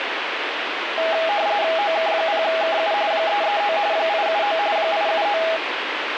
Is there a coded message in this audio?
Yes: RTTY (45.45 baud, 170 Hz shift) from 1.0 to 5.6 s, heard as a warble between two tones, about 740 Hz centre, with radio static. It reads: OK0KU 339 879 879